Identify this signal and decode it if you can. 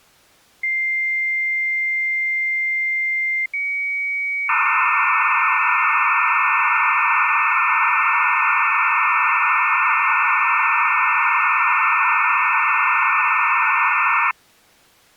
Dial-up modem handshake (low-speed, two carriers), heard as two whistles, then hiss.